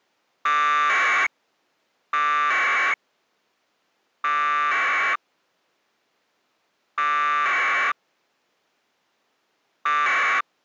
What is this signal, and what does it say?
Packet radio (AX.25, as in APRS), 1200 baud, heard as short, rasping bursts.